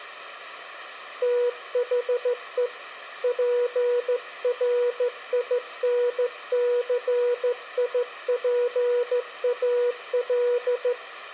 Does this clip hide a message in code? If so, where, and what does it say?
Yes: Morse code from 1.2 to 11.0 s, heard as a keyed tone, hand-sent with a straight key, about 14 wpm, 490 Hz. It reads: THE PRINCIPAL